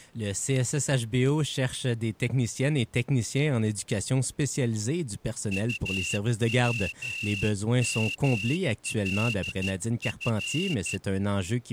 Morse code, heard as a whistle, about 13 wpm. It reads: UWMLF